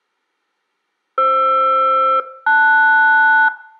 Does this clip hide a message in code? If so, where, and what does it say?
Yes: aircraft SELCAL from 1.2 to 3.5 s, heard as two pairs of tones, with room echo. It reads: FR-LS